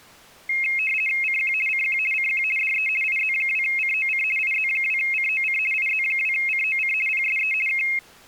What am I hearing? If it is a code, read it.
RTTY (50 baud, 450 Hz shift), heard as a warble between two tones, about 2350 Hz centre. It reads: CQ CQ CQ DE IZ2COC IZ2COC IZ2COC PSE K